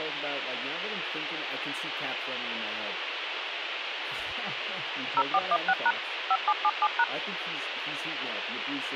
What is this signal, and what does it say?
DTMF, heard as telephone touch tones, dialled by machine, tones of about 50 ms, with phone line noise and speech in English. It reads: 0416# 5777#